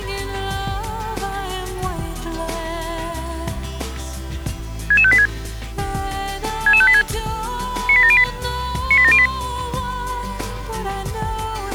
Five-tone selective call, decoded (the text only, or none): 66586 66586 98708 98708